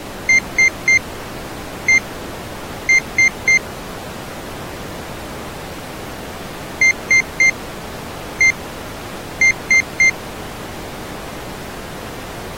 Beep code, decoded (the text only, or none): 3-1-3